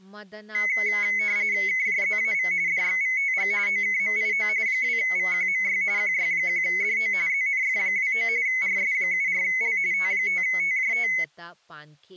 RTTY (45.45 baud, 170 Hz shift), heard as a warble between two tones, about 2100 Hz centre, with speech in Manipuri. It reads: KJZAV DXVTG OKMIO 2VQMY QY1DO ZNF29 RS74L T5TJT